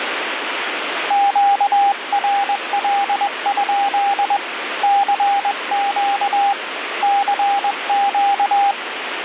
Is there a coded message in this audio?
Yes: Morse code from 1.0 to 8.8 s, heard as a keyed tone, hand-sent with a paddle, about 21 wpm, 800 Hz, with radio static. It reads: QRL? CQ CQ